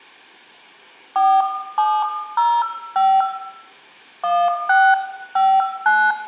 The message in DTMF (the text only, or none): 4705 1659